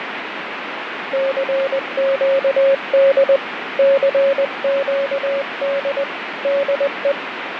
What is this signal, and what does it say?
Morse code, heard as a keyed tone, hand-sent with a paddle, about 20 wpm, 550 Hz, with radio static and fading. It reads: CQD CQD DE